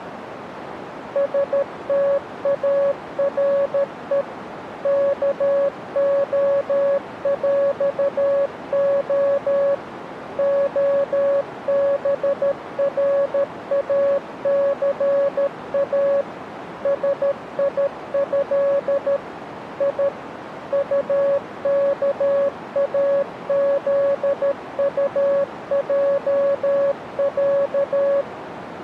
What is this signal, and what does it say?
Morse code (with Polish letters), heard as a keyed tone, machine-sent, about 13 wpm, 560 Hz, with radio static and a narrow filter. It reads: STARE KOŁO OBRACA SIĘ I UKAZUJĄ